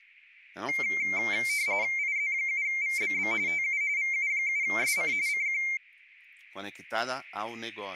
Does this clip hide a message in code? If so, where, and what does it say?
Yes: RTTY (45.45 baud, 170 Hz shift) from 0.7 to 5.8 s, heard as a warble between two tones, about 2200 Hz centre, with speech in Portuguese. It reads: IZ7VBB TU VU7SC CQ